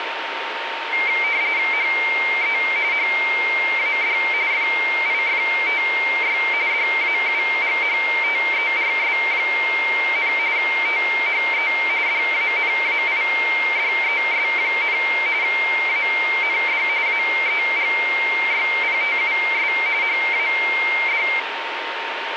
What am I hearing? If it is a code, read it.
RTTY (45.45 baud, 170 Hz shift), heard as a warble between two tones, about 2200 Hz centre, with radio static and a steady whistle near 920 Hz. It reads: HE HAD FIFTY DAUGHTERS, THE DANAIDES, AND AEGYPTUS HAD